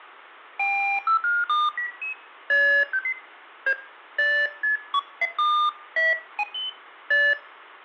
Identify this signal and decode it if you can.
Electronic bleeps of random pitch and length, with room echo. There is no code.